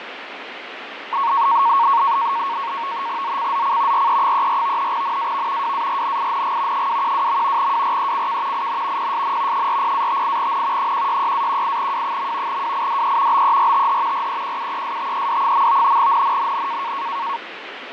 NAVTEX (SITOR-B), 100 baud, 170 Hz shift, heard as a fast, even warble, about 1010 Hz centre, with radio static and fading. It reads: ZCZC RE34 NAV WARNING 212. WRECK IN PSN 40-58N 166-18W. WIDE BERTH REQUESTED. NNNN